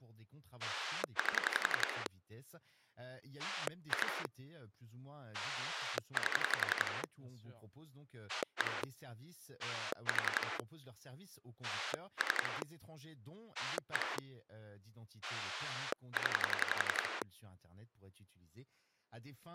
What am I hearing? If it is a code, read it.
Pulse dialling, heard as a rotary dial, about 11 pulses a second, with speech in French. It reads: 8 2 8 1 4 3 1 0